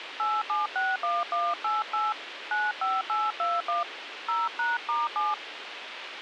DTMF, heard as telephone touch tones, dialled by hand, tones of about 180 ms, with radio hiss. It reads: 8761188 95821 0#*7